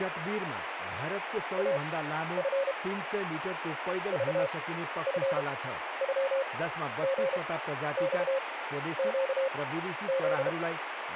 Morse code (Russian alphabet), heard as a keyed tone, machine-sent, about 32 wpm, spaced as for 12 wpm, 540 Hz, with radio static and speech in Nepali. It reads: АФ ЖФЮГЬЩЗ